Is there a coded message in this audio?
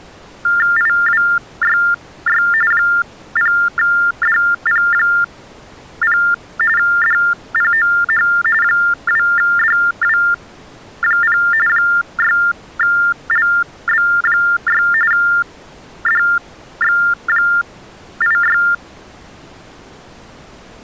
Yes: TTY/TDD text telephone tones (45.45 baud Baudot) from 0.4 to 18.7 s, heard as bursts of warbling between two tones, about 400 Hz shift, 1600 Hz centre. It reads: IWYY 0DP0 DPOH 2DW0 6LB6 DX86